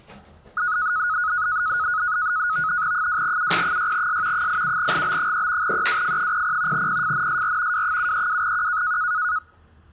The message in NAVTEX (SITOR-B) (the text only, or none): 2UP6S 87GB3 EWF00 PFNSR W732Q